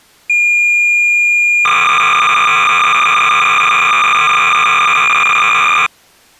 Cassette data (Kansas City type), 300 baud, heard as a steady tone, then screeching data.